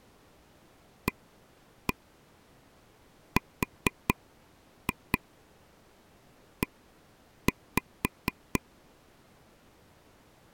Tap code, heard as taps on a table, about 4 knocks a second. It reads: ARE